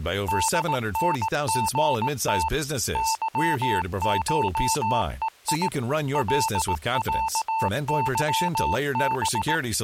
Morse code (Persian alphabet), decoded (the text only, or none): دنژت ظشهی لصظب